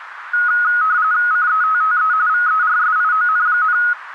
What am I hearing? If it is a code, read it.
RTTY (45.45 baud, 170 Hz shift), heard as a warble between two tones, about 1360 Hz centre, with radio static. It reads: CETTE VERSION,